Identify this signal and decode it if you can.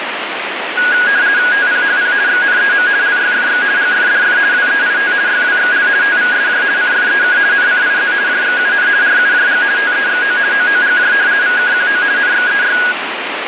RTTY (50 baud, 170 Hz shift), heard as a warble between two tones, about 1550 Hz centre, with radio static. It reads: TPHP XNEM LYFX GFDF WEIT YWXL TVSJ CFEK NCIZ JXUN RUJG TEXO OOGJ VKQO NXEY